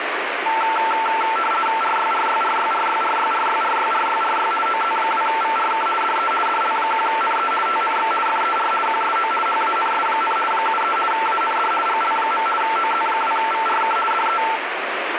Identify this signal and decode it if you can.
RTTY (50 baud, 450 Hz shift), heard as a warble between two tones, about 1120 Hz centre, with radio static. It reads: RYRYRYRYRYRYRYRYRY OZ2VRK DE DL1NE TNX FER QSO HANS, 73 AND GL. OZ2VRK DE